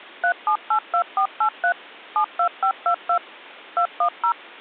DTMF, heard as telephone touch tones, dialled by machine, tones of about 90 ms. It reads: 3782483 72522 210